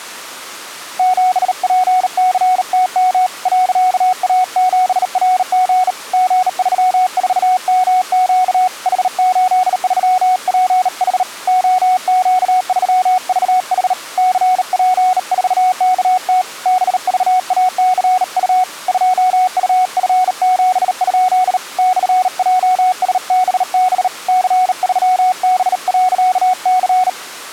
Morse code, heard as a keyed tone, hand-sent with a bug key, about 38 wpm, 740 Hz. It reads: 7PCTM .A7RG G34MQ H83PH OQ3VH CP4KT BVACU 2UF7? /JSBB C3B.C